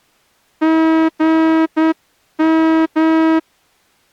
Morse code, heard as a horn, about 9 wpm. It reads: GM